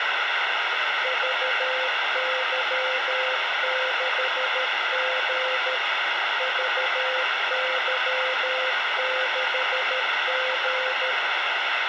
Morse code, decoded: VY6G VY6G

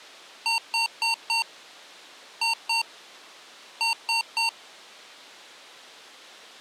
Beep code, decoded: 4-2-3

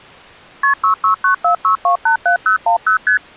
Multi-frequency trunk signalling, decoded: KP 66946287010 ST

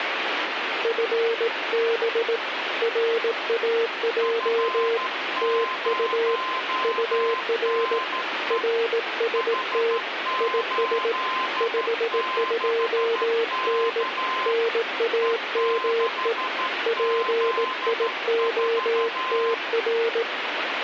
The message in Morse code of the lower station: FB RAJ TU UR RST IS 52N NAME PIOTR

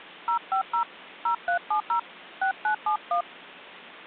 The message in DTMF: 050 0370 6971

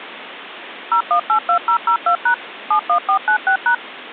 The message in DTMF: 0182002# 71496#

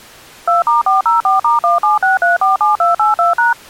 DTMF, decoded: 2*404*176347282#

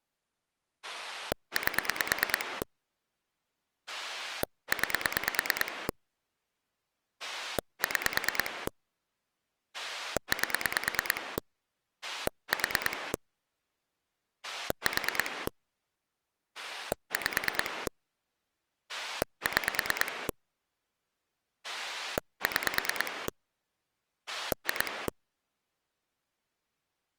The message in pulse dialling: 8 9 6 8 4 4 5 6 6 2

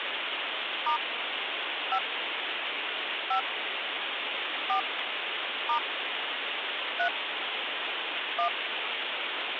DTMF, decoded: * 5 5 4 * 3 1

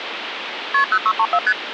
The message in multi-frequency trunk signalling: KP 0634 ST

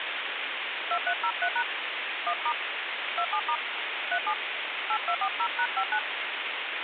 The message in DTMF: 2303# 1* 27* 37 8240#59

